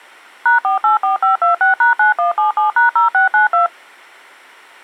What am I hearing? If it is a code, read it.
DTMF, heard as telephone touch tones, dialled by machine, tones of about 130 ms. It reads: #484526#9177#0692